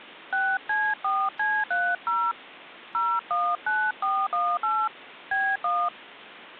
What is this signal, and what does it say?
DTMF, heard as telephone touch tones, dialled by hand, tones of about 250 ms. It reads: 6C4C30 019418 B1